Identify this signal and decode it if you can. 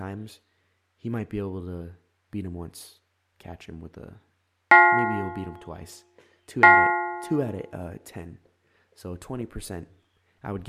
Clock strike, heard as a bell, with speech in English. 2. Two o'clock.